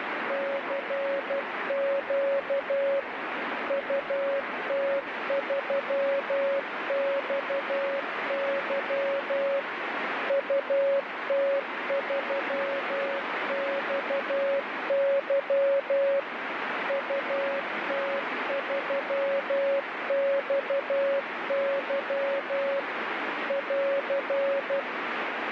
Morse code, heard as a keyed tone, machine-sent, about 12 wpm, 550 Hz, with heavy radio static. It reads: CQ UT3XY UT3XY UT3XY <AR>